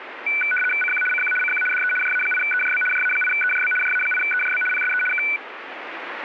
RTTY (75 baud, 850 Hz shift), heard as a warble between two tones, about 1900 Hz centre, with radio static. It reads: CQ CQ CQ DE JA8EJB JA8EJB JA8EJB PSE K